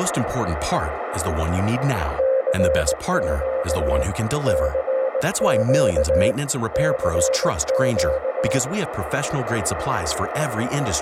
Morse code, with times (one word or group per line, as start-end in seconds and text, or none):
2.2-4.0 CQ
4.5-6.3 CQ
6.7-8.6 CQ